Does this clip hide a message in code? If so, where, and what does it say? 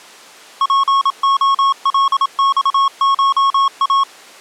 Yes: Morse code (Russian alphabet) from 0.6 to 4.1 s, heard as a keyed tone, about 27 wpm, 1100 Hz. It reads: ПОЛЬША